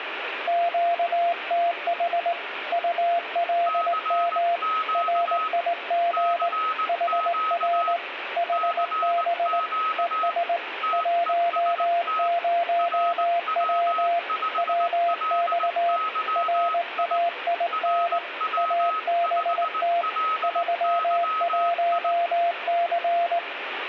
Morse code, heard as two keyed tones, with radio static. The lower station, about 19 wpm, 690 Hz: QTH ULM RIG HR HB ES 10W WX RAIN ABT 31C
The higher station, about 19 wpm, 1280 Hz: CQ CQ CQ TEST RW5LYI RW5LYI